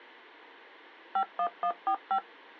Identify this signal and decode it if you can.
DTMF, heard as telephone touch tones, dialled by machine, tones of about 80 ms. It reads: 51145